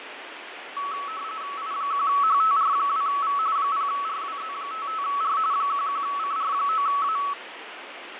RTTY (45.45 baud, 170 Hz shift), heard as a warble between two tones, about 1220 Hz centre, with radio static and fading. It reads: I1HTR2V 0RWZ55R 11CR9A